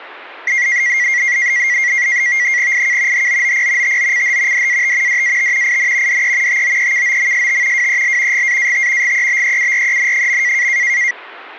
NAVTEX (SITOR-B), 100 baud, 170 Hz shift, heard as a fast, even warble, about 2050 Hz centre. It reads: IK HOOP TOCH DAT DAT IN DE TOEKOMST WEL GAAT GEBEUREN.